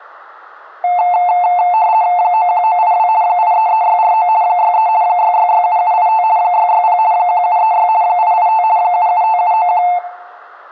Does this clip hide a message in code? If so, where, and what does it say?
Yes: RTTY (50 baud, 170 Hz shift) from 0.8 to 10.0 s, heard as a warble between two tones, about 800 Hz centre, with room echo. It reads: 91982 833649 63 6667785 660 1736 885 775791